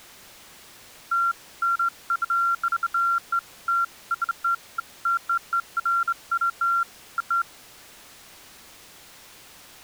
Beeps of irregular length. There is no code.